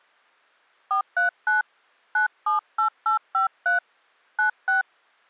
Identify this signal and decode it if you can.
DTMF, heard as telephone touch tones, dialled by hand, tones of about 130 ms. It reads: 439 978853 96